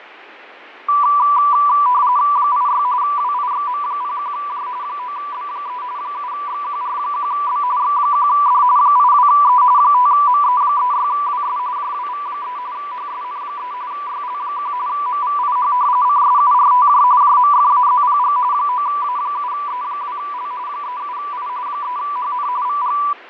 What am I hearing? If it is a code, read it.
RTTY (45.45 baud, 170 Hz shift), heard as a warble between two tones, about 1080 Hz centre, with radio static and fading. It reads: 86 WIXM01J 9B3 7XQR1B X1D 82E 5ME36WS JWV3 HSN3 YL1 MVIH CSURTJ JMFAZPG 9A7E2L 37I 3HN VG